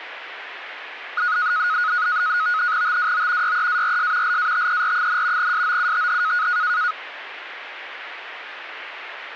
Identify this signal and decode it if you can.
NAVTEX (SITOR-B), 100 baud, 170 Hz shift, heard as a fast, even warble, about 1360 Hz centre, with radio static. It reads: TWO YEARS LATER, SOUTH